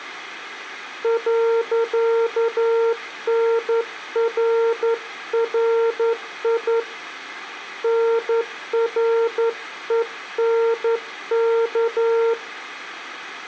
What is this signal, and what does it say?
Morse code, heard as a keyed tone, hand-sent with a straight key, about 11 wpm, 460 Hz. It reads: .NRRI NRENK